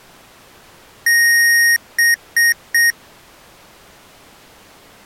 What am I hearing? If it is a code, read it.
Beep code, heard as beeps from a small speaker, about 1850 Hz. 1 long, 3 short. In Award and IBM BIOS tables: video adapter failure; in AMI BIOS tables: memory failure.